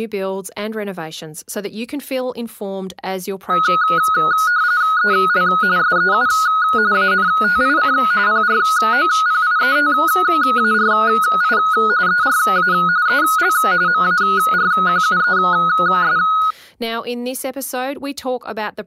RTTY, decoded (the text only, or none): EL SEU ANTIC PROPIETARI ERA EL MARQUES